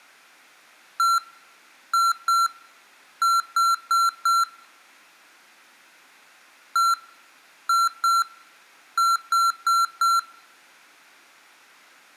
Beep code, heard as beeps from a small speaker, played twice, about 1360 Hz, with room echo. 1-2-4.